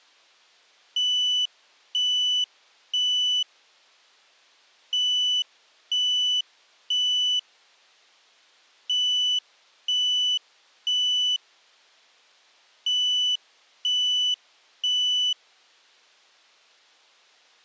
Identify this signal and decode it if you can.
Alarm pattern, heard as an alarm's beeps, played four times, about 3000 Hz. Temporal three. Smoke or fire, evacuate.